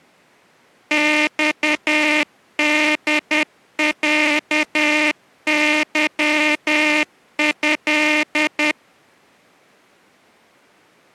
Morse code (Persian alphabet), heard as a buzzer, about 10 wpm. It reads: خدصظض